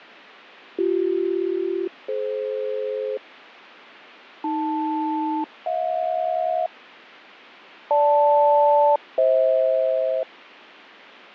Aircraft SELCAL, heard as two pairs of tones, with radio static and fading. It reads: BC-DF AL-HJ GL-FH